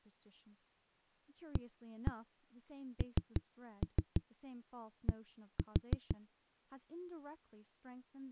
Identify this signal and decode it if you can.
Tap code, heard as knocks on a wall, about 6 knocks a second, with speech in English. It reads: AND